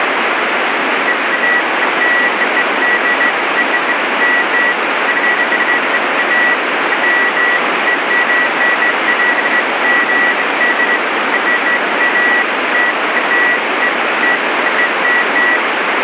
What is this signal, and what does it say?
Beeps of irregular length, with radio static. There is no code.